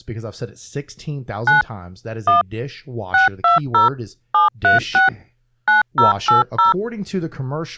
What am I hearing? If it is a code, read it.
DTMF, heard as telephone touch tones, dialled by machine, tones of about 140 ms, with speech in English. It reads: 9 1 620 736 9080